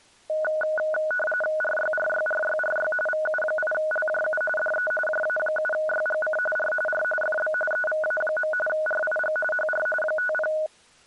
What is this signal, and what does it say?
RTTY (45.45 baud, 850 Hz shift), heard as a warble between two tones, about 1050 Hz centre. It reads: RYRYRYRY VU8LJU DE JA7YGC R R FB EVA. RIG HR 50